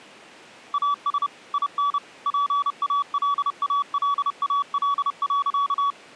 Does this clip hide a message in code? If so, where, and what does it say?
Yes: Morse code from 0.7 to 6.0 s, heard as a keyed tone, machine-sent, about 30 wpm, 1140 Hz. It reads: AS IN PALALAL.